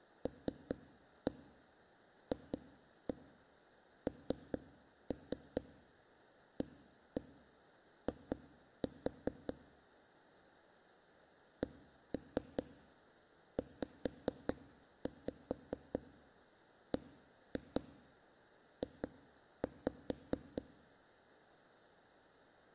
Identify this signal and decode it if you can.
Tap code, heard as knocks on a wall, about 4 knocks a second. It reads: LFNAI CZBJ